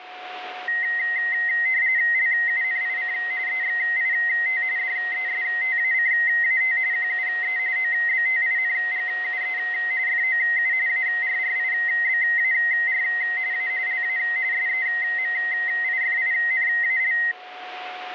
RTTY (45.45 baud, 170 Hz shift), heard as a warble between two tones, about 1950 Hz centre, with radio static and a steady whistle near 730 Hz. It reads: LUNIC EXIT DESTACAT QUE OBTINGUE FOU ARRIBAR A LA SEMIFINAL